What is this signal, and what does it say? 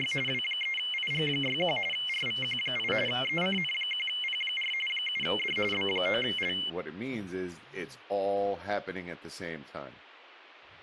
RTTY (45.45 baud, 850 Hz shift), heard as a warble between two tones, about 2550 Hz centre, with speech in English. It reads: … W3IG61 RVQ8 ECN1P4 7D B9L